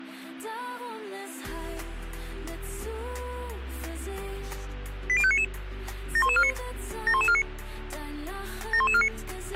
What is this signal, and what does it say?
Five-tone selective call (ZVEI), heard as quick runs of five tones, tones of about 70 ms, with a squelch burst at the end. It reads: 80599 71149 71149 71149